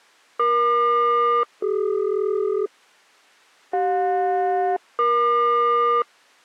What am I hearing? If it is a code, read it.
Aircraft SELCAL, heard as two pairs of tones. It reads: EQ-CD CJ-EQ